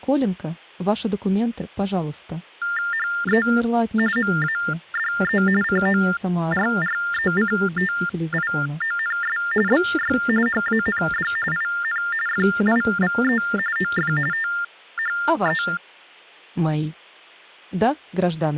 TTY/TDD text telephone tones (45.45 baud Baudot), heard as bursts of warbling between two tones, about 400 Hz shift, 1600 Hz centre, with hum. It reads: HE MADE CORRECTIONS BY HAND IN FIVE OF THE